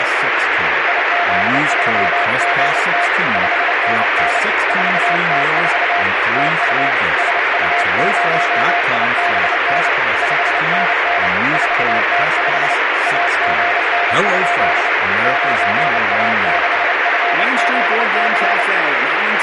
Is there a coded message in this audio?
Yes: Morse code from 0.8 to 18.7 s, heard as a keyed tone, hand-sent with a paddle, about 29 wpm, 700 Hz, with heavy radio static and speech in English. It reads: IZ3GT 5NN 4T4 TU SU0IBN 5NN 4T5 AGN? 9A6FZC